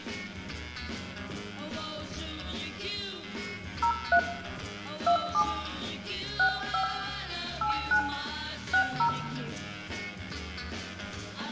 DTMF, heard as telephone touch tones, dialled by hand, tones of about 90 ms, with room echo. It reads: 03 27 65 89 60